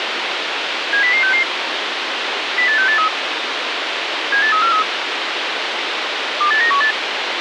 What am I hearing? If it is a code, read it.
Five-tone selective call (CCIR), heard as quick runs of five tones, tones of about 100 ms, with radio hiss. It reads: 70066 08683 78343 28918